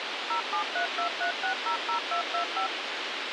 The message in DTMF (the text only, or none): 07323600225